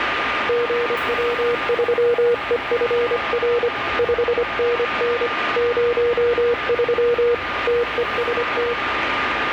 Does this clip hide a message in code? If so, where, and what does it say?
Yes: Morse code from 0.4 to 8.8 s, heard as a keyed tone, hand-sent with a paddle, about 25 wpm, 480 Hz, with radio static, a steady whistle near 1210 Hz and the noise inside a subway train. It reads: GW3EFR 5NN 03 TEST